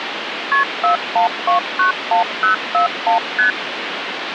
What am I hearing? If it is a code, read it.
Multi-frequency trunk signalling (R1, as on North American trunks), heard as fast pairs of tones, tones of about 120 ms, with phone line noise. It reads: KP 41291041 ST